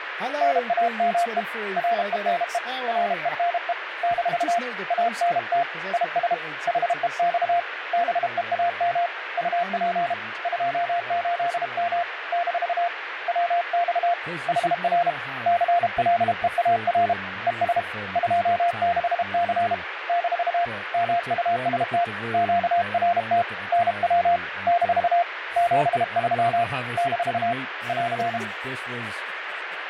Morse code, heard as a keyed tone, hand-sent with a paddle, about 32 wpm, 700 Hz, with radio static and speech in English. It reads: NAME RENE RENE - ANT IS HEX BEAM UP 28M - WX HR CLEAR ES 26C - MUST QRT NW - 73 - <AR>